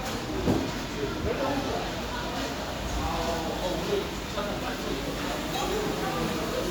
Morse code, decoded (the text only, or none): none